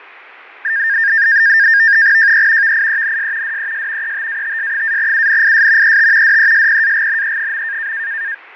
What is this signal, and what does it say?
NAVTEX (SITOR-B), 100 baud, 170 Hz shift, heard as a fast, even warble, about 1700 Hz centre, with radio static and fading. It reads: JE VIENS DES ETATS-UNIS ET DESPAGNE.